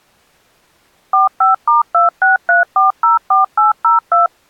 DTMF, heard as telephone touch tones, dialled by machine, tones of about 140 ms. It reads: 45*263404802